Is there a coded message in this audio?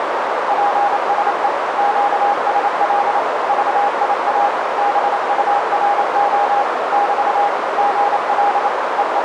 Yes: Morse code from 0.4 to 9.2 s, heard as a keyed tone, machine-sent, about 28 wpm, 810 Hz, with heavy radio static and a narrow filter. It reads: PSE QSL VIA BURO <BT> GL …